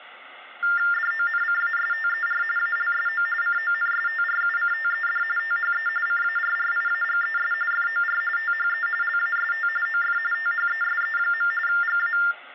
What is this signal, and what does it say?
TTY/TDD text telephone tones (45.45 baud Baudot), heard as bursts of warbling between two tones, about 400 Hz shift, 1600 Hz centre, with phone line noise. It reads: DONCASTER ALSO CONSTRUCTED THE CARRIAGES FOR THE LAST OF THESE. GA